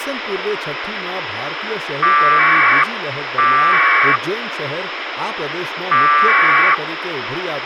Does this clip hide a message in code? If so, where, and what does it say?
Yes: packet radio (AX.25, as in APRS), 1200 baud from 2.0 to 6.7 s, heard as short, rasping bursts, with radio hiss and speech in Gujarati.